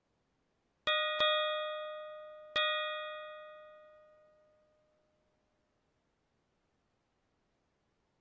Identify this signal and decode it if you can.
Ship's bell, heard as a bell. 3. Three half-hours of the watch have passed.